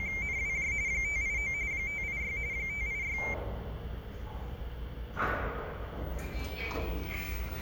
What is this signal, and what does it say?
RTTY (45.45 baud, 170 Hz shift), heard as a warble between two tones, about 2200 Hz centre, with the noise inside a lift. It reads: … 589 586 586